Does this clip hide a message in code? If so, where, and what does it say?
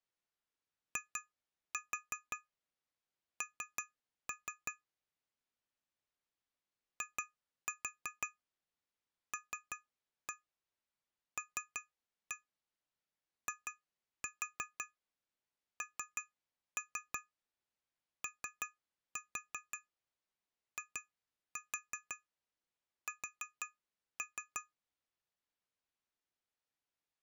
Yes: tap code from 1.0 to 24.7 s, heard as taps on glass, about 5 knocks a second. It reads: IN ILLINOIS